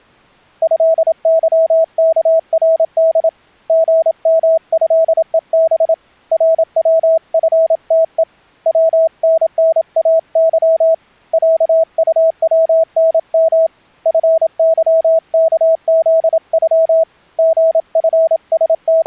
Morse code (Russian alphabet), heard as a keyed tone, hand-sent with a paddle, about 27 wpm, 650 Hz. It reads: ЭЫКРД ГМЭЕБ РВФТЕ ВННАЫ ЯУВНМ ФЫКЗЮ …